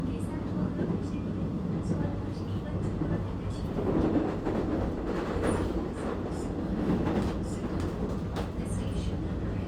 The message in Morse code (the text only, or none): none